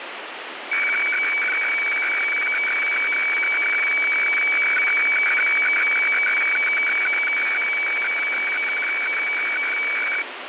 Weather fax (radiofax), 120 lines a minute, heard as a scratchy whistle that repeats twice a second, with radio static.